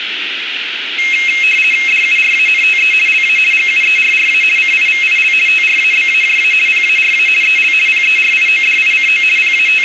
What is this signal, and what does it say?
RTTY (50 baud, 450 Hz shift), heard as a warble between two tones, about 2350 Hz centre, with radio static. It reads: DURANTE LA GUERRA CIVIL TRABAJA PARA EL PERIODICO …